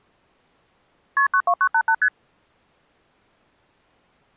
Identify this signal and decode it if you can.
Multi-frequency trunk signalling (R1, as on North American trunks), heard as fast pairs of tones, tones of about 70 ms. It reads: KP 92988 ST